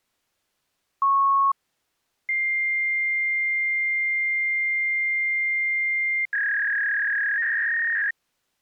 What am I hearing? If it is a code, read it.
Fax machine handshake, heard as a beep, a long tone and a warble.